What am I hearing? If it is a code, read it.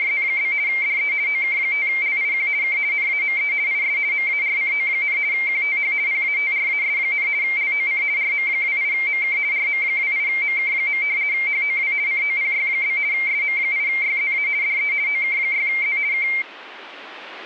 RTTY (50 baud, 170 Hz shift), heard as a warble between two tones, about 2200 Hz centre. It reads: … DE OK5LIQ K NAME IS MARCO, QTH PATRAS, LOC RM28MK RM28MK. HOW COPY? SM8YZA DE OK6Z K